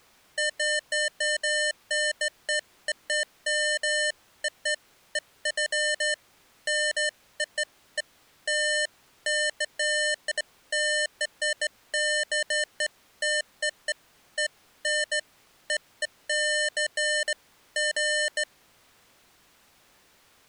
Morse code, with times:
none

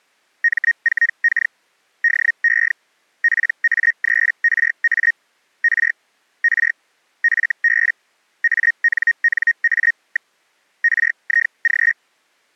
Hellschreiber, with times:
0.4-1.5 M4K
2.0-2.7 DE
3.2-5.1 PA3RA
5.6-5.9 R
6.4-6.7 R
7.2-7.9 FB
8.4-10.3 ANNA.
10.8-11.9 RIG

